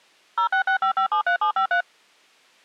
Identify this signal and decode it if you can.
DTMF, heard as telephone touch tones, dialled by machine, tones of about 100 ms. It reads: 0665573753